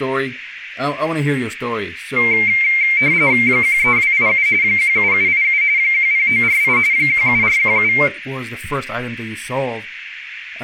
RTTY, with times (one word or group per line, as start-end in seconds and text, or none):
3.5-4.5 13287
4.6-5.6 17787
5.8-6.8 10948
6.9-7.9 17417